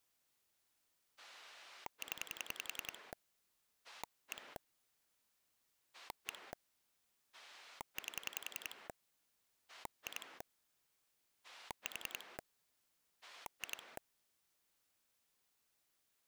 Pulse dialling, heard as a rotary dial, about 10 pulses a second. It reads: 0 1 1 8 2 4 2